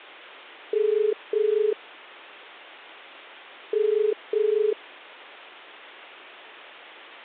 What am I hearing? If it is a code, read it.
Telephone call progress tone (as in the UK, Ireland, Australia and similar networks), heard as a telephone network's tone, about 430 Hz. Ringback tone.